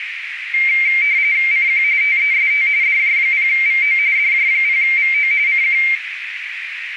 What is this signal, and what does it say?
RTTY (45.45 baud, 170 Hz shift), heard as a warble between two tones, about 2200 Hz centre, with radio static and a narrow filter. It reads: CQ TEST DJ0VO DJ0VO CQ